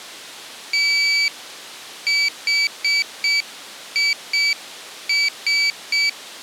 Morse code, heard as a high beeper, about 6 wpm, 2300 Hz. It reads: THIS